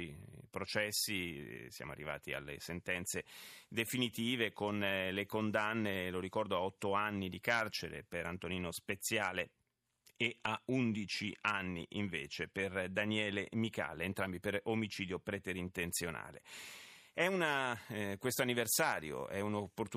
Speech in Italian. There is no code.